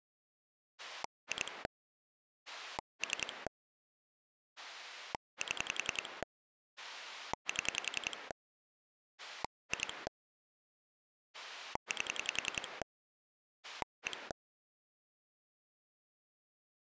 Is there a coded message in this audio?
Yes: pulse dialling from 0.8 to 14.3 s, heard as a rotary dial, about 10 pulses a second. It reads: 2 3 7 7 2 8 1